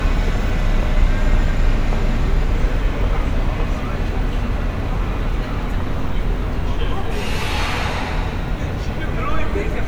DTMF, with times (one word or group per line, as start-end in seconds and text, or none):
none